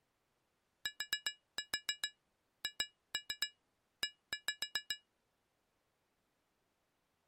Tap code, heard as taps on glass, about 7 knocks a second. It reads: THE